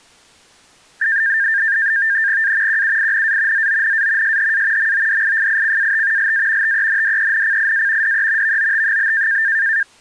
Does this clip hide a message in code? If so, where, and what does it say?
Yes: NAVTEX (SITOR-B), 100 baud, 170 Hz shift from 1.0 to 9.8 s, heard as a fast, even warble, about 1700 Hz centre. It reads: A QUINA ZONA SHA MODIFICAT LA TENDENCIA DE VOT?